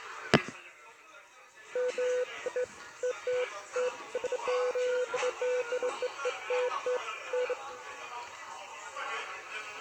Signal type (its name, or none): none